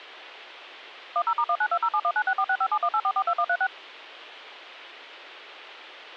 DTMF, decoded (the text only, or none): 10*19207196465718442136